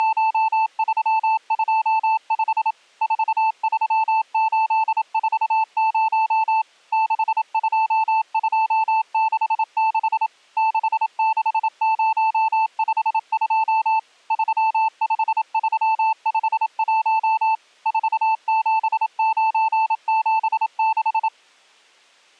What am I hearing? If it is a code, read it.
Morse code, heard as a keyed tone, machine-sent, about 27 wpm, 880 Hz. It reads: … 43840 62266 66052 35351 47976